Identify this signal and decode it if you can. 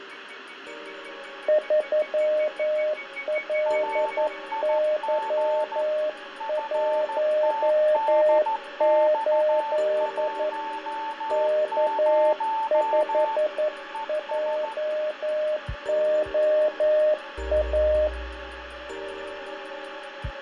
Morse code, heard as two keyed tones, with radio static, fading and room echo. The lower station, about 11 wpm, 610 Hz: 3LY18 K5JOA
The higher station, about 14 wpm, 890 Hz: RIG FTDX10 ES